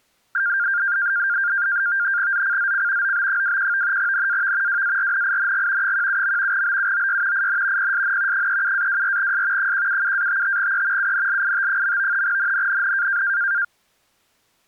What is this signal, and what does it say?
NAVTEX (SITOR-B), 100 baud, 170 Hz shift, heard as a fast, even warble, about 1500 Hz centre. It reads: ZCZC OB21 NAV WARNING 17. BUOY IN PSN 37-24S 177-55E UNLIT. NNNN